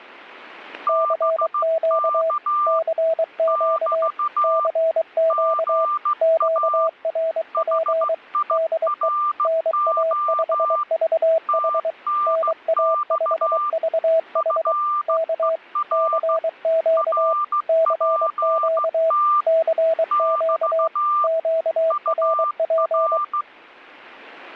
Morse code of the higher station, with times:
0.9-2.8 BK
3.5-4.7 <BT>
5.3-6.9 GA
7.5-10.8 HIRO
11.5-13.7 TNX
14.4-16.4 FER
17.0-19.4 RPT
20.1-21.3 <BT>
21.9-23.4 UR

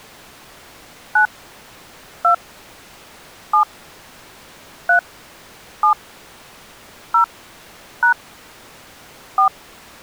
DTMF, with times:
1.2-1.3 9
2.2-2.3 2
3.5-3.6 7
4.9-5.0 3
5.8-5.9 7
7.1-7.2 0
8.0-8.1 #
9.4-9.5 4

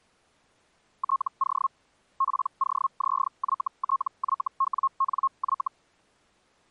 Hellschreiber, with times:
1.0-1.7 TO
2.2-5.7 POZYTYWNY

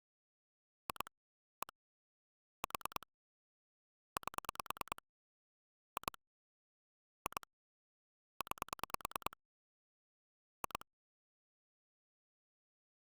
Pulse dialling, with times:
0.9-1.1 2
1.6-1.7 1
2.6-3.1 4
4.2-5.0 8
6.0-6.2 2
7.3-7.5 2
8.4-9.4 9
10.6-10.9 2

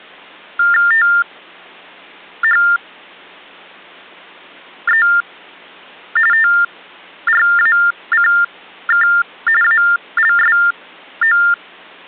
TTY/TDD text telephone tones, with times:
0.9-5.1 THE
6.3-9.1 TRACK
9.6-11.4 ALSO

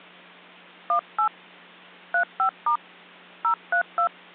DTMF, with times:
0.9-1.3 18
2.1-2.8 35*
3.4-4.1 032

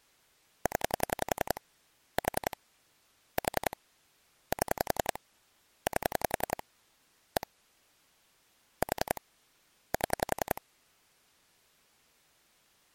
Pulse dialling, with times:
0.7-1.6 0
2.2-2.6 4
3.4-3.8 4
4.5-5.2 7
5.9-6.6 8
7.4-7.5 1
8.8-9.2 4
9.9-10.6 7

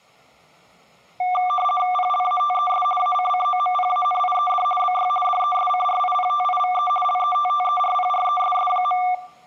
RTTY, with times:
1.9-2.8 PLATES
3.0-4.6 ACCOMPANIED
4.8-5.1 BY
5.2-6.9 DESCRIPTIVE
7.0-9.0 LETTERPRESS.

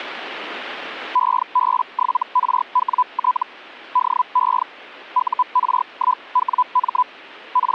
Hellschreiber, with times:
1.1-3.4 EB7RWT
3.9-4.6 DE
5.1-7.0 UR1WM
7.5-7.7 …

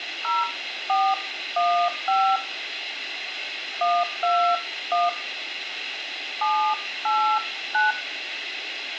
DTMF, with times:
0.2-2.4 0415
3.8-5.1 121
6.4-7.9 789

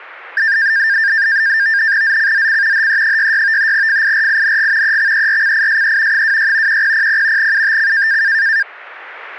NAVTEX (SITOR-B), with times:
2.0-2.9 ZCZC
2.7-3.7 HE66
3.7-5.0 FIRING
4.8-6.2 EXERCISE
6.1-6.8 26
6.7-7.5 1000
7.4-8.2 UTC

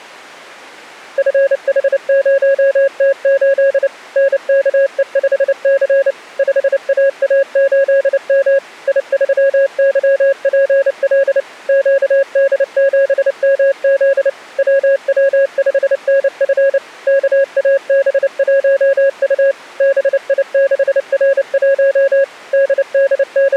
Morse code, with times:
1.2-3.9 FH0T8
4.2-6.1 NKE5C
6.4-8.6 5AA8M
8.9-11.4 I3YPL
11.7-14.3 QD7MZ
14.6-16.8 WW5NF
17.1-19.5 KAB1U
19.8-22.2 BI6R1
22.5-23.6 …

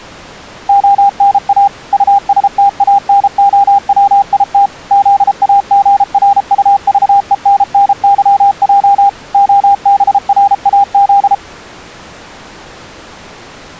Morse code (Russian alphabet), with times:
0.7-1.7 ОНА
1.9-4.7 УСТАНОВИТ
4.9-9.1 ЗАГРУЖЕННЫЙ
9.3-11.3 ОБРАЗ

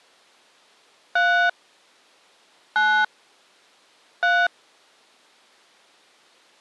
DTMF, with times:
1.2-1.5 3
2.8-3.0 9
4.2-4.5 3

